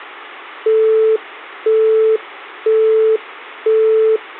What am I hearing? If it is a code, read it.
Telephone call progress tone (single-tone plan, as in Europe, Japan and elsewhere), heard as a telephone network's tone, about 440 Hz, 0.5 s on and 0.5 s off. Busy tone.